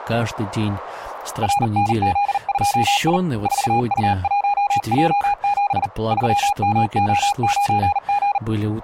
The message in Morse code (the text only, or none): RNZ2I 4U1J7 3MO9G